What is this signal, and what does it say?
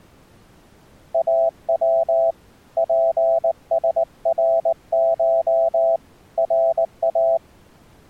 Morse code (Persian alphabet), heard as a keyed tone, hand-sent with a paddle, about 19 wpm, 660 Hz. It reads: او پسرش را